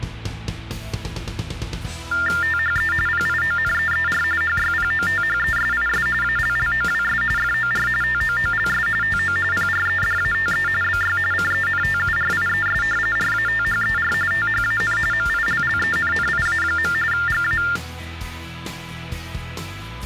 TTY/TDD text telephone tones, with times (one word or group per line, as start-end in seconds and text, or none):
2.4-2.9 THE
3.1-4.2 PIONEER
4.4-6.1 HYPOTHESIS
6.2-7.2 ALLOWS
7.4-7.9 FOR
8.0-8.9 TOOLS
9.0-9.4 TO
9.5-10.7 PREDATE
10.8-11.2 BY
11.3-12.8 CENTURIES
13.2-14.1 RATHER
14.3-15.0 THAN
15.1-16.9 MILLENNIA.
17.1-17.6 GA